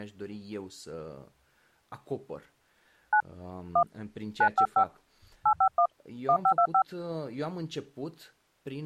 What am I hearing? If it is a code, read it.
DTMF, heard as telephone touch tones, dialled by hand, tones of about 80 ms, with speech in Romanian. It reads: 9 1 955 851 1525